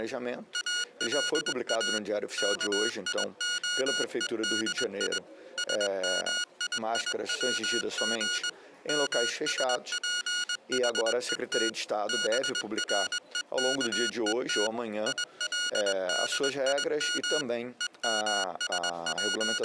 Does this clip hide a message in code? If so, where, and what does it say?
Yes: Morse code (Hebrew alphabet) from 0.5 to 19.6 s, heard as electronic beeps, machine-sent, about 21 wpm, 1440 Hz. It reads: אלא כיהודי שמייצג משפחות ברוכות ילדים …